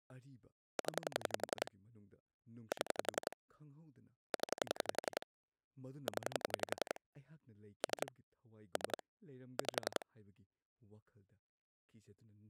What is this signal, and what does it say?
Pulse dialling, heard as clicks on a phone line, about 11 pulses a second, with speech in Manipuri. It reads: 0 7 0 0 3 3 5